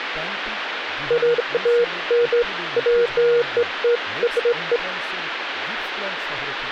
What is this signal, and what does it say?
Beeps of irregular length, with phone line noise and speech in Bangla. There is no code.